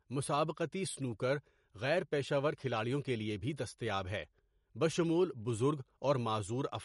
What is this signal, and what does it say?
Speech in Urdu. There is no code.